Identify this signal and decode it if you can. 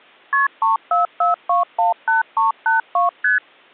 Multi-frequency trunk signalling (R1, as on North American trunks), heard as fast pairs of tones, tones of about 140 ms. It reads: KP 344218382 ST